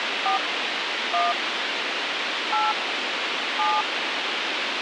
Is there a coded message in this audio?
Yes: DTMF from 0.3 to 3.8 s, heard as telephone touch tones, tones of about 160 ms, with radio hiss. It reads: 4 1 8 7